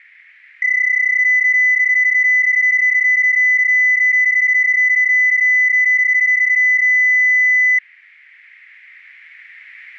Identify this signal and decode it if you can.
PSK31 (31.25 baud), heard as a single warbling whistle, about 2000 Hz.